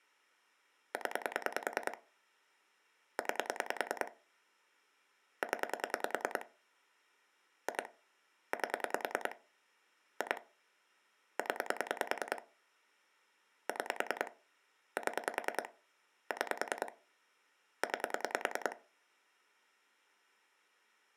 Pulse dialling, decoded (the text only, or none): 0 9 0 2 8 2 0 6 7 6 9